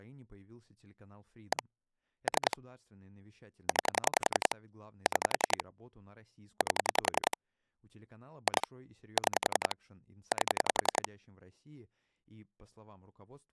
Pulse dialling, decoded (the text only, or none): 1 3 9 6 8 2 6 8